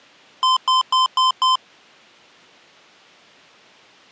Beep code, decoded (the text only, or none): 5 short